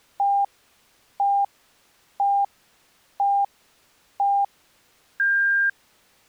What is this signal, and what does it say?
Radio time signal (five pips and a higher one, as on Chinese radio), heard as pips.